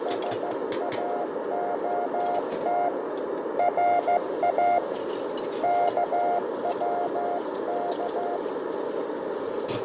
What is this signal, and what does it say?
Morse code (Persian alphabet), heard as a keyed tone, hand-sent with a straight key, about 14 wpm, 700 Hz, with radio static, fading, a narrow filter, room echo and kitchen noise. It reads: ساعت را کوک